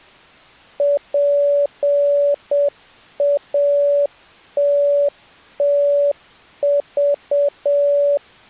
Morse code (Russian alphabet), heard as a keyed tone, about 7 wpm, 570 Hz. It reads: ПАТТЖ